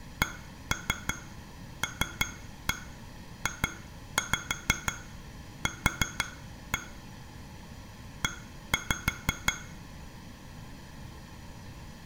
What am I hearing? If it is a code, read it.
Tap code, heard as taps on glass, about 6 knocks a second, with room echo. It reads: CLJQ E